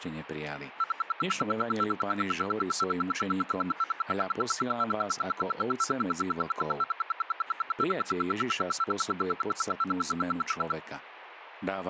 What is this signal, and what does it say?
Radio time signal (RWM, Moscow), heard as ten pulses a second, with speech in Slovak.